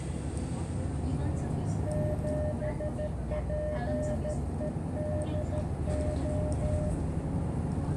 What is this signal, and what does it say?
Morse code, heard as a keyed tone, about 13 wpm, 600 Hz, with radio static, a narrow filter and the noise inside a bus. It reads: 7PEDO